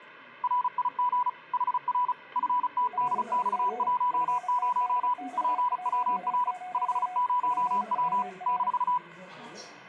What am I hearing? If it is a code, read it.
Morse code, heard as two keyed tones, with the noise inside a lift. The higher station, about 35 wpm, 990 Hz: RIG HR FTDX10 PWR 50W -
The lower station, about 32 wpm, 730 Hz: RIG FTDX10 PWR